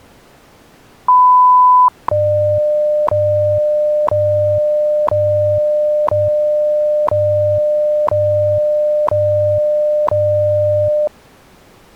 Radio time signal (WWV, Colorado), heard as ticks, one a second.